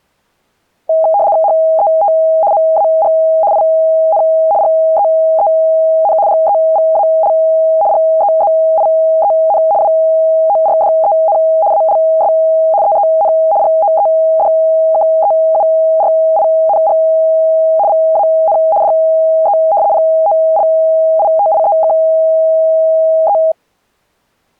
RTTY (75 baud, 170 Hz shift), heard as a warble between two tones, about 730 Hz centre. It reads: HET MAG IN GEEN GEVAL GEZIEN WORDEN ALS EEN GOEDKEURING VAN DE POLITIEKE